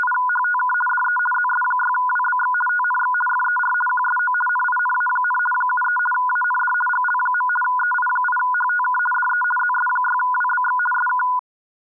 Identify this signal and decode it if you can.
RTTY (50 baud, 450 Hz shift), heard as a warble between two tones, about 1220 Hz centre. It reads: … DE ZS6WBX TNX FER QSO NINA, 73 AND GL. EI8HTK DE ZS6WBX SK